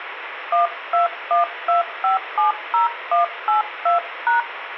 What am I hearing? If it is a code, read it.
DTMF, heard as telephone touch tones, dialled by hand, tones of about 130 ms, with radio hiss. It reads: 1212570182#